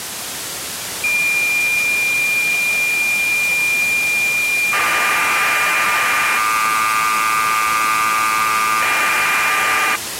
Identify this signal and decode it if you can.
Cassette data (Kansas City type), 1200 baud, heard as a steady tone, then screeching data, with tape hiss.